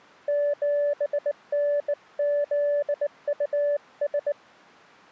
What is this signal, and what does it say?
Morse code, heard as a keyed tone, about 19 wpm, 580 Hz. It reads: 7NZUS